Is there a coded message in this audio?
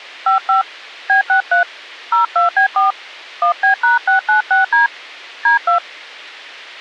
Yes: DTMF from 0.3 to 5.8 s, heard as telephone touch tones, dialled by hand, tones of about 120 ms. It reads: 55 B63 02B4 1B#696D D2